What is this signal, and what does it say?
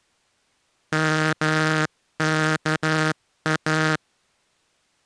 Morse code (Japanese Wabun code), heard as a buzzer, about 13 wpm. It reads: ヨワイ